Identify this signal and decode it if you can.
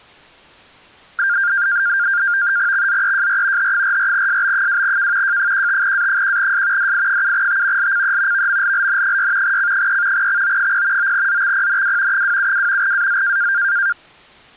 NAVTEX (SITOR-B), 100 baud, 170 Hz shift, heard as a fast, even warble, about 1500 Hz centre. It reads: XZEJR H44SB2K J15A1S DI7T LCE VMLLN6 C3 XO0 9ZXPNW 272 AZ